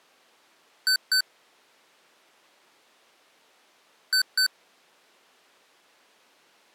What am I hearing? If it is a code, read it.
Beep code, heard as beeps from a small speaker, played twice, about 1500 Hz. 2 short. In AMI BIOS tables: memory parity error; in IBM BIOS tables: self-test error shown on screen; in Dell tables: no memory detected.